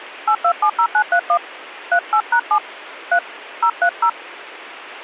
DTMF, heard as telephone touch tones, dialled by hand, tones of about 80 ms. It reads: 8270931 38#7 3 030